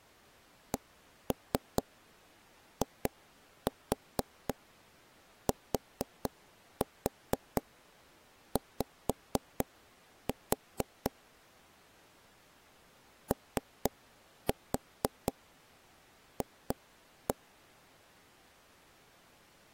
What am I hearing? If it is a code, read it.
Tap code, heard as taps on a table, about 4 knocks a second. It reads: CITY OF